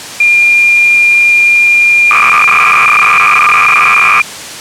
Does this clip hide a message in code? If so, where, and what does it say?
Yes: cassette data (Kansas City type), 300 baud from 0.2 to 4.2 s, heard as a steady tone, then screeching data.